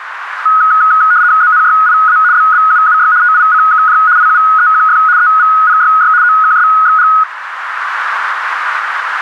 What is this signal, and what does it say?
RTTY (75 baud, 170 Hz shift), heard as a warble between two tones, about 1360 Hz centre, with radio static and a narrow filter. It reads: ZNYIA BBUUY TICKJ IUEQF EVPYY OKSXG